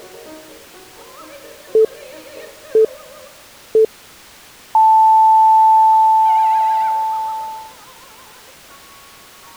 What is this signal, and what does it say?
Radio time signal (three low pips and a long one an octave up, as on NHK), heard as pips.